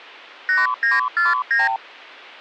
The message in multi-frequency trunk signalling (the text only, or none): 8949